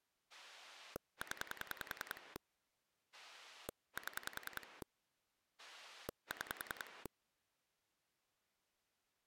Pulse dialling, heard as a rotary dial, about 10 pulses a second. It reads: 0 7 6